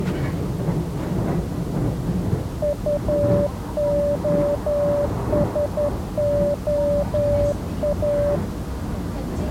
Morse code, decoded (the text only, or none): UOSOA